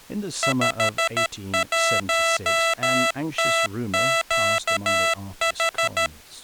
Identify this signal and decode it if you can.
Morse code, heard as electronic beeps, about 13 wpm, 660 Hz, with speech in English. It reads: 51TQH